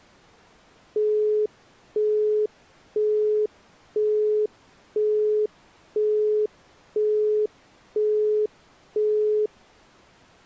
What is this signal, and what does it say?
Telephone call progress tone (single-tone plan, as in Europe, Japan and elsewhere), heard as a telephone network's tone, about 420 Hz, 0.5 s on and 0.5 s off. Busy tone.